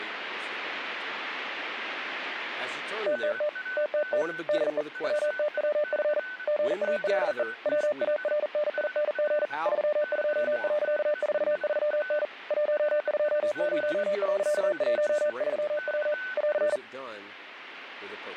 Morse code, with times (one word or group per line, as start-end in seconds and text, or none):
3.1-3.5 TTT
3.8-4.2 TTT
4.5-4.8 DE
5.0-6.2 WTWF
6.5-7.4 GALE
7.7-9.5 WARNING
9.7-12.2 32.43N
12.5-16.1 120.13W
16.4-16.8 <AR>